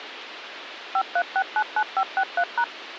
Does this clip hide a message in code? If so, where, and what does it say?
Yes: DTMF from 1.0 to 2.6 s, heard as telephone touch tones, dialled by machine, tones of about 60 ms, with radio hiss. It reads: 53699563#